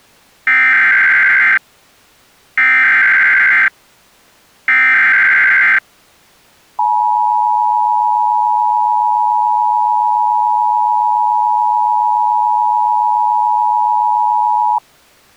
Emergency Alert System (SAME) tones (header bursts, then the 853 and 960 Hz attention tone), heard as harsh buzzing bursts, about 520.83 baud.